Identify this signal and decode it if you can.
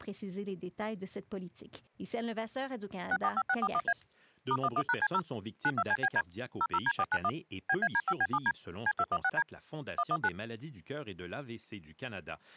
DTMF, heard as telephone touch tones, dialled by machine, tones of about 50 ms, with speech in French. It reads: 645641A *11#C0 92CBD 00D491 BAD5B7D C216D 119